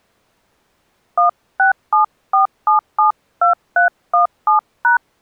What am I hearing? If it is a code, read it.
DTMF, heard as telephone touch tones, dialled by hand, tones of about 120 ms. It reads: 1674772317#